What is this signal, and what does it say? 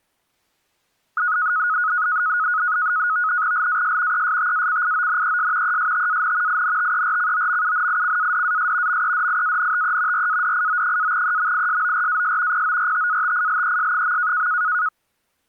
NAVTEX (SITOR-B), 100 baud, 170 Hz shift, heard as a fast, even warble, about 1360 Hz centre. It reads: LAS ESTACIONES ESTAN INTERCOMUNICADAS MEDIANTE RADIO-EMISORAS PORTATILES.